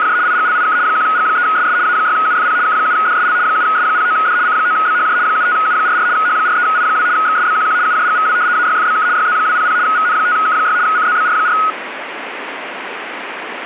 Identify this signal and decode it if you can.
RTTY (75 baud, 170 Hz shift), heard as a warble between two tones, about 1360 Hz centre, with radio static. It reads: … IGLIK 1G3SS A6UFP K7DSL 7S09D C9BHJ 75U44 H43I2 XSBQQ UJGVW AYFBK YZ200 VN5K6 CZBR4